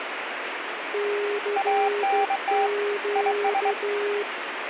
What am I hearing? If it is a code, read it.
Morse code, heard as two keyed tones, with radio static. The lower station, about 12 wpm, 410 Hz: CQ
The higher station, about 23 wpm, 790 Hz: ANT IS